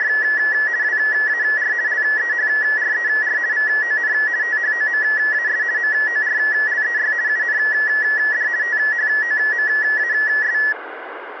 RTTY (50 baud, 170 Hz shift), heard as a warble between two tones, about 1800 Hz centre, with radio static. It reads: … WAR LEHRER VON THOMAS MORLEY UND THOMAS